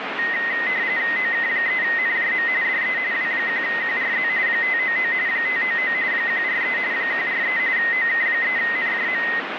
RTTY (45.45 baud, 170 Hz shift), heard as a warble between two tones, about 1950 Hz centre, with radio static. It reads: OK3NJM DE W1QRZ 599 599 143 143 OK3NJM